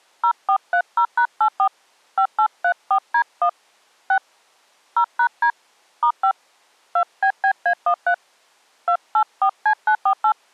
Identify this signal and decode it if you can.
DTMF, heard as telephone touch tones, dialled by hand, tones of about 80 ms. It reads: 0430#84 5834D1 6 0#D *5 2BBA13 284C948